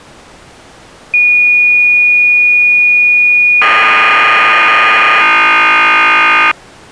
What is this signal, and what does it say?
Cassette data (Kansas City type), 1200 baud, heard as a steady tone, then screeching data.